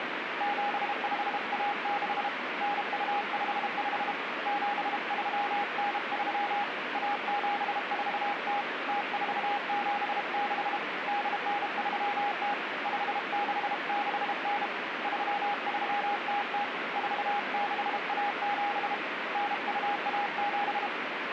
Morse code (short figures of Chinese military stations), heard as a keyed tone, hand-sent with a bug key, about 32 wpm, 820 Hz, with radio static. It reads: 7516 9255 7393 1740 0476 8930 5669 3300 4617 9217